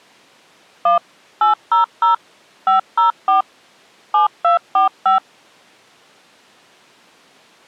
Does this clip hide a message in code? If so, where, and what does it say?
Yes: DTMF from 0.9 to 5.2 s, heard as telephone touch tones, dialled by machine, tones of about 130 ms. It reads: 1 800 504 7245